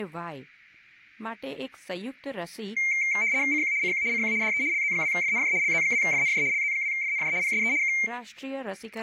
RTTY (75 baud, 170 Hz shift), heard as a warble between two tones, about 2200 Hz centre. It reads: CQ CQ CQ DE LZ2FNJ LZ2FNJ LZ2FNJ PSE K